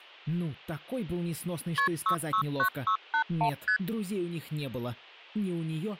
Multi-frequency trunk signalling (R1, as on North American trunks), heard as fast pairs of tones, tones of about 90 ms, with hum. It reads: KP 669681 ST